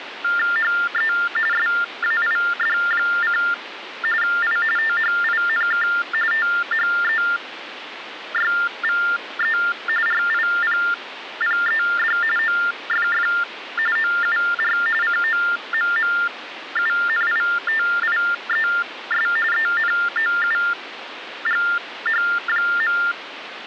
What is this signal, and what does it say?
TTY/TDD text telephone tones (45.45 baud Baudot), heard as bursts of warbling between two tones, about 400 Hz shift, 1600 Hz centre, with phone line noise. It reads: HE SAID: I THINK THEYVE RIPPED OFF OUR COMMUNITIES ENOUGH.